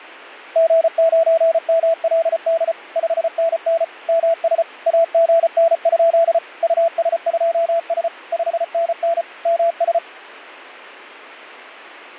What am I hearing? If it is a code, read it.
Morse code, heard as a keyed tone, machine-sent, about 34 wpm, 670 Hz. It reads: G9MLD 5NN MS AGN? US2S 5NN MS